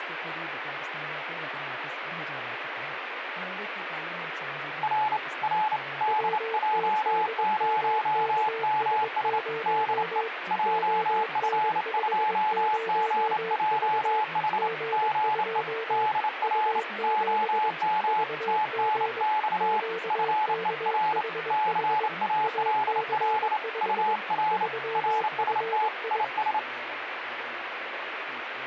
Morse code, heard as two keyed tones, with radio static. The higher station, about 28 wpm, 860 Hz: R R DJ0MS DE JF2GJH GE DR OM TNX FER CALL UR RST IS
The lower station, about 22 wpm, 450 Hz: WTDMKS0 ON50V G2 U7 VG QKHH AC5 3FI